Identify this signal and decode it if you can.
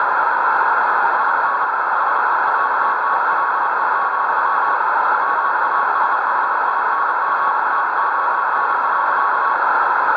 Morse code, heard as a keyed tone, hand-sent with a paddle, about 29 wpm, 1110 Hz, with heavy radio static and a narrow filter. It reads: IN SEATTLE, WASHINGTON.